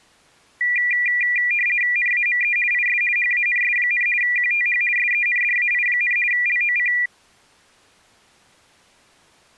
RTTY (50 baud, 450 Hz shift), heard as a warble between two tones, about 2200 Hz centre. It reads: NAME IS HANS, QTH SENDAI, LOC